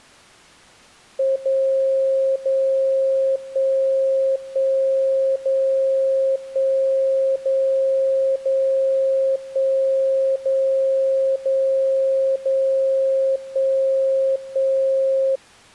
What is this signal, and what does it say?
Radio time signal (DCF77), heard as a tone whose level steps once a second, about 540 Hz. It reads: 0 0 1 1 0 1 0 0 1 0 0 0 1 1